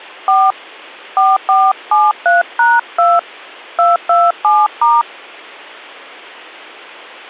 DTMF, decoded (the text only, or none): 4 4473#2 227*